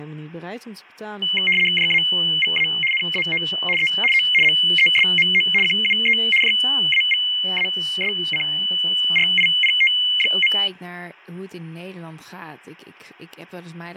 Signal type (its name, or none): RTTY